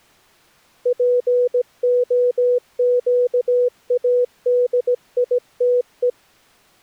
Morse code (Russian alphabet), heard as a keyed tone, hand-sent with a paddle, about 17 wpm, 490 Hz. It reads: ПОЩАДИТЕ